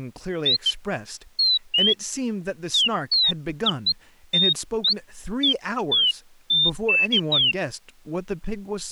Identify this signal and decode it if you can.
Bird-like chirps, with speech in English. There is no code.